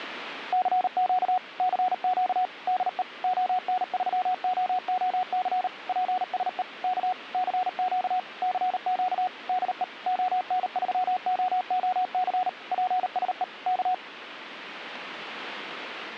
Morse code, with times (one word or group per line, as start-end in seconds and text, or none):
0.5-1.4 CQ
1.6-2.5 CQ
2.7-3.0 DE
3.2-5.7 ON3OOC
5.9-6.6 PSE
6.8-7.1 K
7.3-8.2 CQ
8.4-9.3 CQ
9.5-9.8 DE
10.1-12.5 ON3OOC
12.7-13.4 PSE
13.7-13.9 K